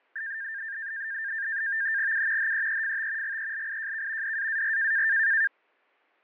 NAVTEX (SITOR-B), 100 baud, 170 Hz shift, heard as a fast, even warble, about 1700 Hz centre, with fading and static crashes. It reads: U HEEFT GELIJK DAAR